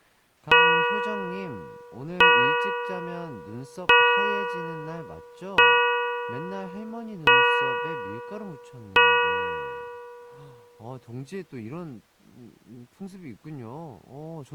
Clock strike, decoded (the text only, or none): 6